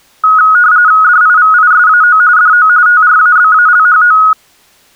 RTTY (45.45 baud, 170 Hz shift), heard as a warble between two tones, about 1360 Hz centre. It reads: DIVISAO DO TRABALHO